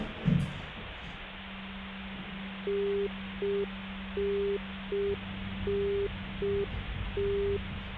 Telephone call progress tone (UK plan), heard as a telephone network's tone, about 400 Hz, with phone line noise and the noise inside a lift. Congestion tone.